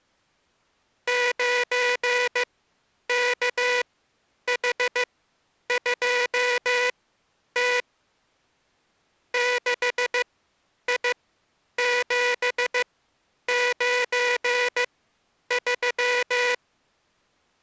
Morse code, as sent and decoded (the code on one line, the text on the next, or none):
----. -.- .... ..--- - / -.... .. --... ----. ...--
9KH2T 6I793